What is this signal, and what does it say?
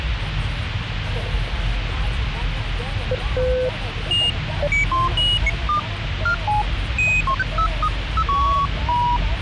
Electronic bleeps of random pitch and length, with radio hiss and the noise inside a car. There is no code.